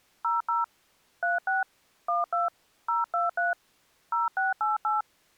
DTMF, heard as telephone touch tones, dialled by hand, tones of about 160 ms. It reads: 00 36 12 023 0688